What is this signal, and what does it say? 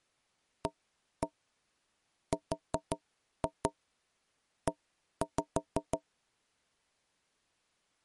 Tap code, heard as knocks on wood, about 5 knocks a second. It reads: ARE